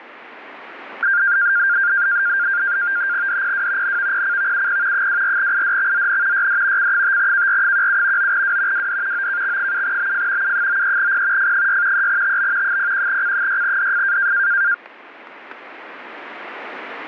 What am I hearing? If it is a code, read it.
NAVTEX (SITOR-B), 100 baud, 170 Hz shift, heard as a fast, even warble, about 1500 Hz centre, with static crashes. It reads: DPW NVPCVUP 24IDXZN YD C5KR17 9W WD OKX7BF U93P F6 3TB 01C6DF